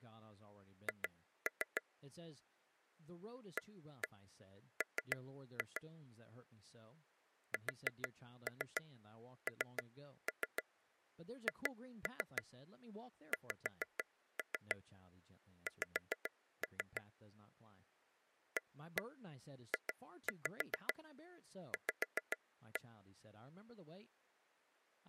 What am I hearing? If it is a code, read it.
Tap code, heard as taps on a table, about 6 knocks a second, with speech in English. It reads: H AM SNHXX AJV